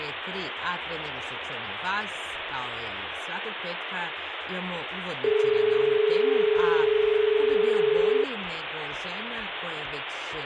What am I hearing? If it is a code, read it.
Telephone call progress tone (as in Australia), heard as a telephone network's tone, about 430 Hz, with phone line noise. Dial tone.